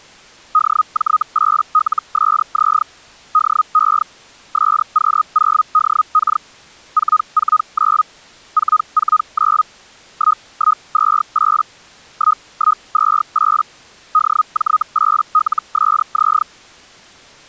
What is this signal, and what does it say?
Hellschreiber (Feld-Hell, 122.5 baud), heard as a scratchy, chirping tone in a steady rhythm, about 1250 Hz. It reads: DJ8LSZ DE SQ0DK 449 449 1128 1128 DJ8LSZ